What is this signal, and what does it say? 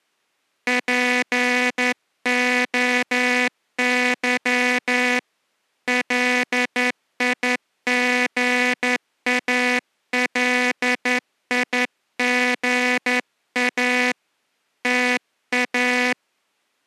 Morse code (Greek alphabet), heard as a buzzer, hand-sent with a straight key, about 11 wpm. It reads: ΠΟΥ ΛΙΓΑΛΙΓΑ ΤΑ